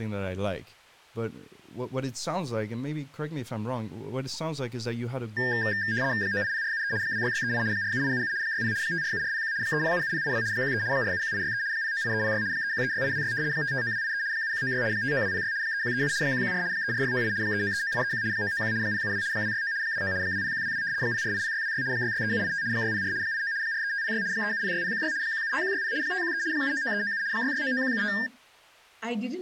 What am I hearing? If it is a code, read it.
RTTY (75 baud, 170 Hz shift), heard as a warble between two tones, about 1700 Hz centre, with speech in English. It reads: 980473 26638 47877 60 547401 3077082 13 471863 098306 3136826 559283 7196 59206 3137 114 34698 3939831 991 072 269 29 20122 0480626 663785 604 89 43506 3706016 175160 513 799397 6699175